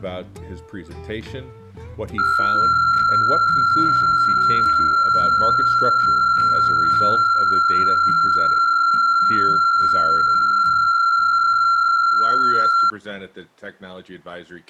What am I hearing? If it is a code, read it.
PSK63 (62.5 baud), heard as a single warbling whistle, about 1370 Hz.